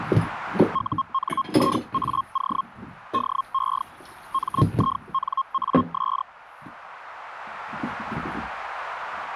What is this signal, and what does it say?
Hellschreiber (Feld-Hell, 122.5 baud), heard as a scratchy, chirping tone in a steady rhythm, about 1070 Hz, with kitchen noise. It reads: UNIAO DE MINAS